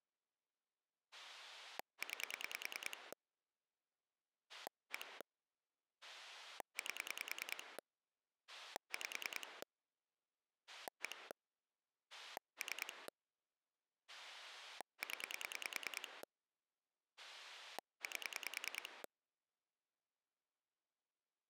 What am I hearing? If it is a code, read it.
Pulse dialling, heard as a rotary dial, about 10 pulses a second. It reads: 9 1 8 5 1 3 0 8